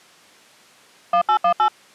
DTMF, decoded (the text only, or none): 1818